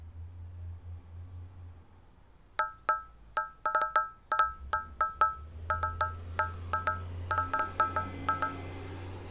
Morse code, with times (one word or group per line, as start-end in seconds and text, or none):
none